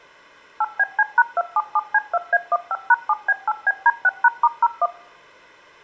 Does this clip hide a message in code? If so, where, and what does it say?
Yes: DTMF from 0.6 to 4.9 s, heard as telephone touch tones, dialled by machine, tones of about 40 ms. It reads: 8BC#277C2A15#7B8BD6#*01